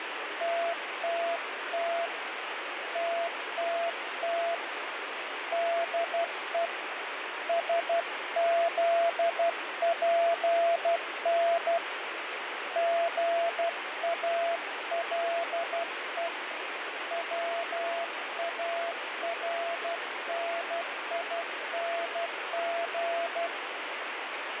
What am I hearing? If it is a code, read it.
Morse code, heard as a keyed tone, hand-sent with a paddle, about 12 wpm, 680 Hz, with radio static and fading. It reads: TTT TTT DE SZPN GALE WARNING